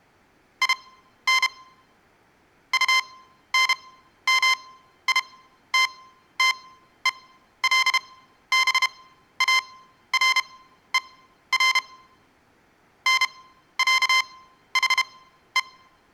Morse code (with German letters), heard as electronic beeps, machine-sent, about 32 wpm, spaced as for 13 wpm, 1040 Hz, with room echo. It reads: IN UNMITTELBARER NÄHE